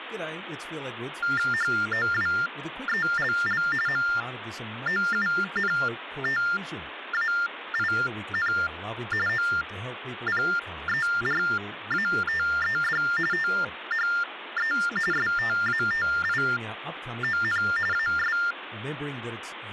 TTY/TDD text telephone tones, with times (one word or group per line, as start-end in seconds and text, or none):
1.5-3.6 HOWELL
3.9-8.5 MOUNTAIN
9.3-13.0 OPERATED
13.3-14.7 THE
15.1-17.6 STATION
17.9-18.4 AS